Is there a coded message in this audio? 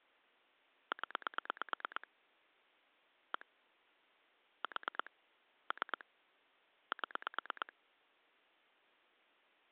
Yes: pulse dialling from 0.9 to 7.7 s, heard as clicks on a phone line, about 9 pulses a second. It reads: 0 1 4 3 7